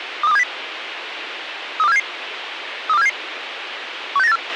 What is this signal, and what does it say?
Five-tone selective call (EEA), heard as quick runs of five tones, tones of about 40 ms, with radio hiss and a squelch burst at the end. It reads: 23270 32477 32477 16984